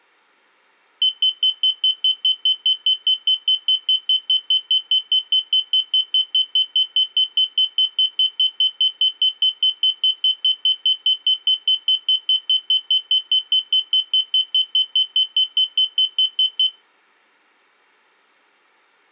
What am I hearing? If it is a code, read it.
Evenly repeated beeps. There is no code.